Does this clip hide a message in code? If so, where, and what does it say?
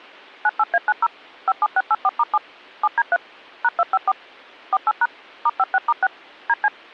Yes: DTMF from 0.5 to 6.7 s, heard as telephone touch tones, dialled by machine, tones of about 40 ms. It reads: 98A90 57684*7 7D3 #254 48# *56*6 DC